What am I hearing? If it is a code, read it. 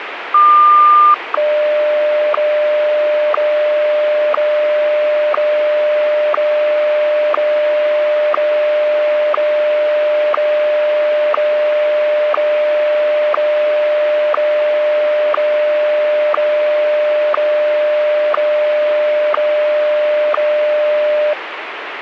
Radio time signal (WWVH, Hawaii), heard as ticks, one a second, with radio static.